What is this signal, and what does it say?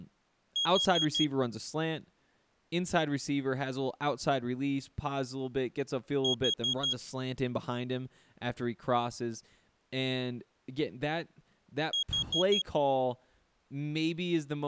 Alarm pattern, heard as an alarm's beeps, played three times, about 3300 Hz, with speech in English. Temporal four. Carbon monoxide.